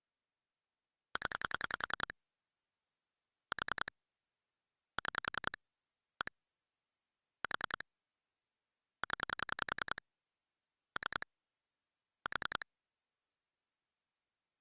Pulse dialling, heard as clicks on a phone line, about 10 pulses a second. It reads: 0 4 6 1 4 0 3 4